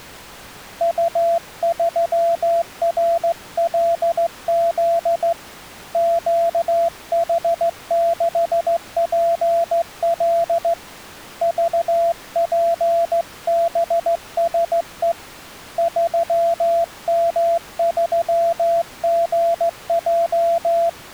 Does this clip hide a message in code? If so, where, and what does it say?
Yes: Morse code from 0.7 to 21.0 s, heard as a keyed tone, hand-sent with a straight key, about 15 wpm, 680 Hz. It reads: U3RLZ QH6PL VPBSE 3M3GJ